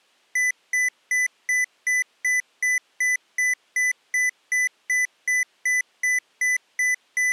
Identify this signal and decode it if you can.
Evenly repeated beeps. There is no code.